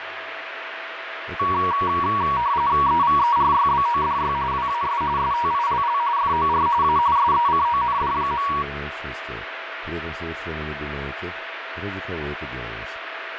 RTTY (45.45 baud, 170 Hz shift), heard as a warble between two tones, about 1040 Hz centre, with radio static and a steady whistle near 660 Hz. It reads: EVERYBODY WAS STILL FOR A SECOND.